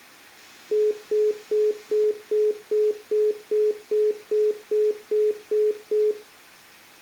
Telephone call progress tone (single-tone plan, as in most of Europe), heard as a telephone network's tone, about 420 Hz, 0.2 s on and 0.2 s off, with room echo. Congestion tone.